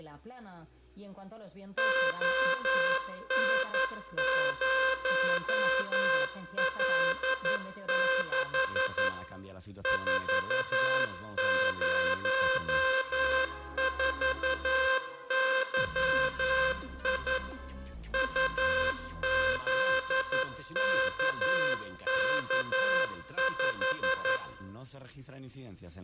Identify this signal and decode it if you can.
Morse code, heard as a buzzer, machine-sent, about 11 wpm, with room echo. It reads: ON0L6 404YI UZKK5